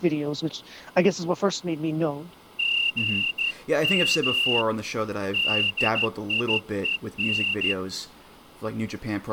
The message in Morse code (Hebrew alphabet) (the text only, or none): גם דיון